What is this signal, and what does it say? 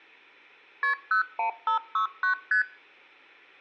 Multi-frequency trunk signalling (R1, as on North American trunks), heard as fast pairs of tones, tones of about 110 ms. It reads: KP 01569 ST